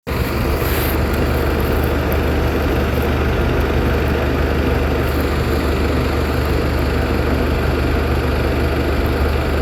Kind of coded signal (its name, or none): none